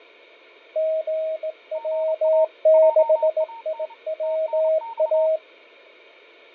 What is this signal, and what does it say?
Morse code, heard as two keyed tones, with fading. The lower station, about 18 wpm, 640 Hz: GW6IWA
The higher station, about 29 wpm, 920 Hz: GA JAN TNX